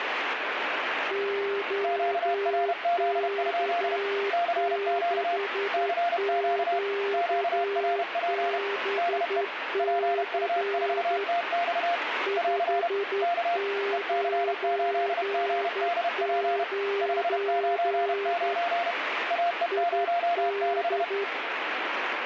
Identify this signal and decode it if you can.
Morse code, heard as two keyed tones, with radio static. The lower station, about 11 wpm, 400 Hz: OK6QBC 599 ID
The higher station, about 31 wpm, 690 Hz: QRZ? CQ CQ QRP DE PU4TX <AR> K EC8GDP 599 AE06